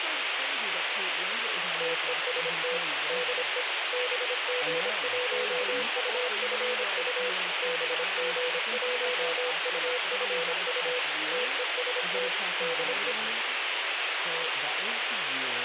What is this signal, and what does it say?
Morse code, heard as a keyed tone, machine-sent, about 26 wpm, 500 Hz, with radio hiss and speech in English. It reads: TEST DE BG1UFU BG1UFU TEST DE